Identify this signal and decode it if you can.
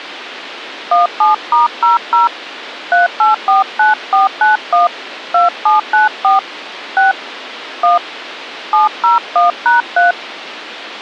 DTMF, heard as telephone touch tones, dialled by hand, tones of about 150 ms, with a squelch burst at the end. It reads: 17*00 3849491 2794 6 1 701#3